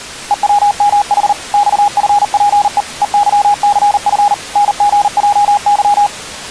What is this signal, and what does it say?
Morse code, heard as a keyed tone, machine-sent, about 39 wpm, 820 Hz. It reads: EWMH XFPE EYCF NGJY